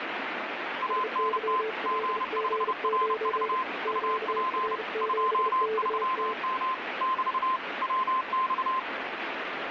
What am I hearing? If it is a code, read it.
Morse code, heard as two keyed tones, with radio static. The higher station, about 30 wpm, 1040 Hz: ANT G5RV UP 23M <BT> WX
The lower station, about 33 wpm, 440 Hz: SYLG9 QR7KT